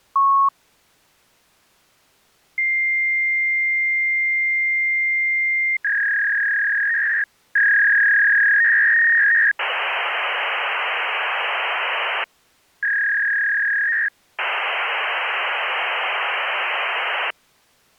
Fax machine handshake, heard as a long tone, a warble and hiss.